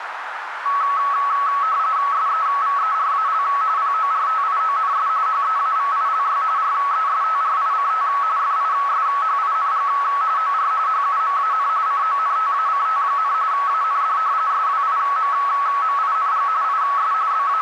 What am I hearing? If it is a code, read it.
RTTY (45.45 baud, 170 Hz shift), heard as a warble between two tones, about 1210 Hz centre, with radio static and a narrow filter. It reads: SEVERAL PORTIONS HEAVILY RESTRICT FISHING OR HUMAN CONTACT, AND SWIMMING IS …